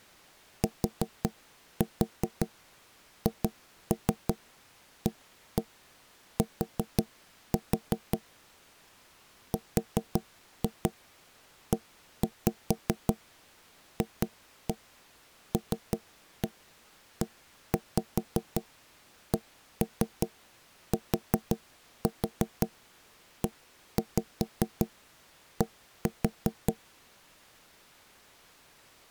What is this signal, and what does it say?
Tap code, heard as knocks on wood, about 5 knocks a second. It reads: THAT REFLECTED